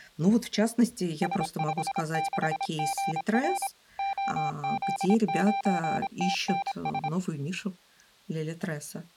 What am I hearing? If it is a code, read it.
Morse code, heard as a keyed tone, machine-sent, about 26 wpm, 790 Hz, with speech in Russian. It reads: S56GR OZ9TNS